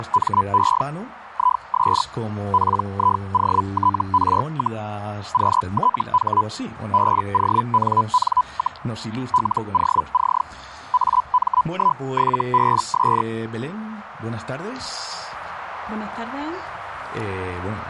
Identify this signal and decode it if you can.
Hellschreiber (Feld-Hell, 122.5 baud), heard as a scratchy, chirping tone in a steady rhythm, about 1000 Hz. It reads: … IS PIOTR, QTH BONN, LOC AM17BS